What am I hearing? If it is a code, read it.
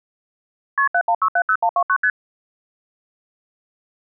Multi-frequency trunk signalling (R1, as on North American trunks), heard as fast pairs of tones, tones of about 70 ms. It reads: KP 71670129 ST